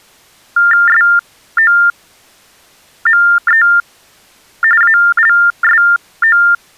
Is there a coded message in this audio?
Yes: TTY/TDD text telephone tones (45.45 baud Baudot) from 0.6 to 6.5 s, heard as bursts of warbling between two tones, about 400 Hz shift, 1600 Hz centre. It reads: SOME ALSO